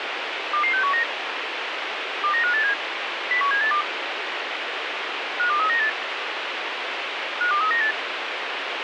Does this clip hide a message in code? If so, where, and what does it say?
Yes: five-tone selective call (CCIR) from 0.5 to 7.9 s, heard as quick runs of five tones, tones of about 100 ms, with radio hiss. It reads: 22619 29587 01782 52398 52398